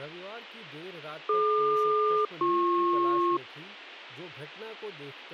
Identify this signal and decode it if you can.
Aircraft SELCAL, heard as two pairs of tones, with speech in Hindi. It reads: DQ-BP